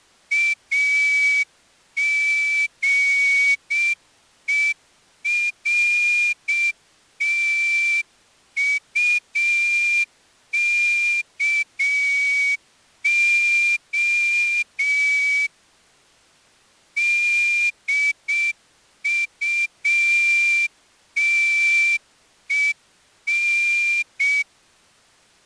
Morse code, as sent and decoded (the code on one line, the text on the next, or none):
.- --. . .-. - ..- -.- --- / -.. ..- - . -.
AGERTUKO DUTEN